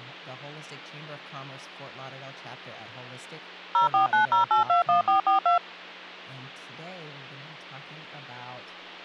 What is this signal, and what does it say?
DTMF, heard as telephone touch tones, dialled by machine, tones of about 120 ms, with hum and speech in English. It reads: 0490821442